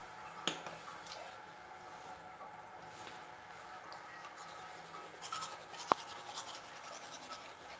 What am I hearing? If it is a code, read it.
The noise of a restroom. There is no code.